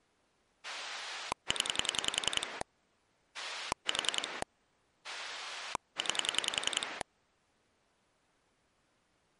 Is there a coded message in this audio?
Yes: pulse dialling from 0.6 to 7.0 s, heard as a rotary dial, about 10 pulses a second. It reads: 0 4 9